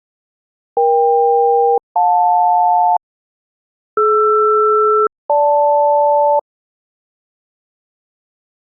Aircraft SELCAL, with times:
0.8-3.0 EK-JL
4.0-6.4 DR-GL

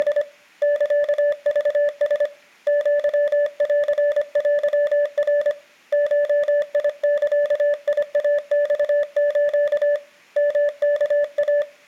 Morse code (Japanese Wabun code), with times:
0.0-0.2 …
0.6-2.3 サクラ
2.7-5.5 アンテナ
5.9-10.0 ゴザイマス
10.4-11.6 ヨワイ

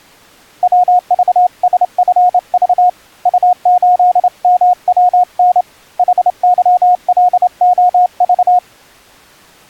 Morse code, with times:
0.6-2.9 WVSFV
3.3-5.6 U8MWN
6.0-8.6 HYLOV

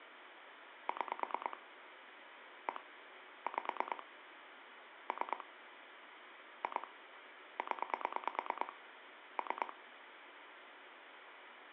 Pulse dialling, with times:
0.9-1.6 6
2.7-2.8 1
3.5-4.0 5
5.1-5.4 3
6.6-6.9 2
7.6-8.7 0
9.4-9.7 3

